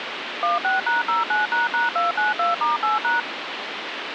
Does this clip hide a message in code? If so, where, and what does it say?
Yes: DTMF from 0.4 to 3.2 s, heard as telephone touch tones, dialled by machine, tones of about 160 ms, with phone line noise. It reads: 16#09##292*8#